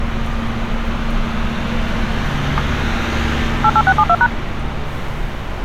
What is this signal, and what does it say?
DTMF, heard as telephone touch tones, dialled by machine, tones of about 60 ms, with street noise. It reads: 88672#